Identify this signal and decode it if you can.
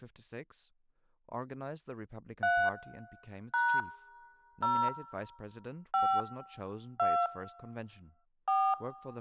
DTMF, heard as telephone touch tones, dialled by hand, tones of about 260 ms, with speech in English. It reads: 3 # 0 5 2 4